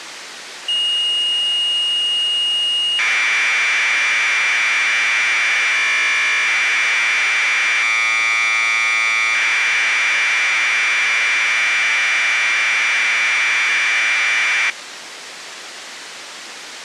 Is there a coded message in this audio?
Yes: Commodore tape loading (standard loader) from 0.7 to 14.7 s, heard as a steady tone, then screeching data, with tape hiss.